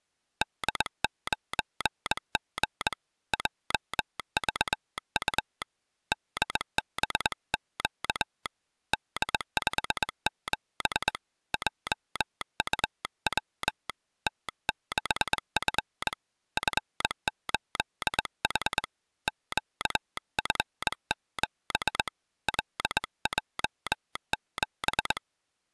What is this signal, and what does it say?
Morse code, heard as a telegraph sounder, hand-sent with a straight key, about 21 wpm. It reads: D9G JVU DBQ D57 JUW T6F F8H QF7 LJ7